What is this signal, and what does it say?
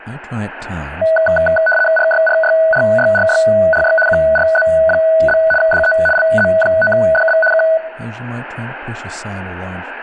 RTTY (75 baud, 850 Hz shift), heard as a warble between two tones, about 1070 Hz centre, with speech in English. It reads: RYRYRYRYRY QRZ? DE LZ9DB K